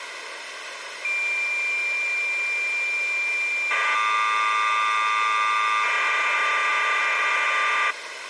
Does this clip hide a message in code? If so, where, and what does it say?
Yes: cassette data (Kansas City type), 1200 baud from 1.0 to 7.9 s, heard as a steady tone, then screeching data, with tape hiss.